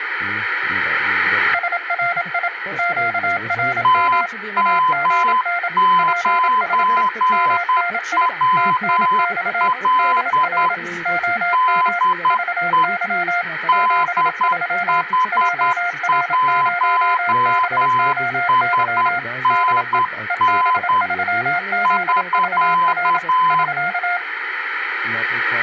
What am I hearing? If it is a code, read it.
Morse code, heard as two keyed tones. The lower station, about 27 wpm, 700 Hz: SRI QRM AGN PSE MNI TNX DR OM VY 73 JR0BOY DE EB3ZVR <SK>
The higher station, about 10 wpm, 1020 Hz: TM9WL DE DH1SNN <SK>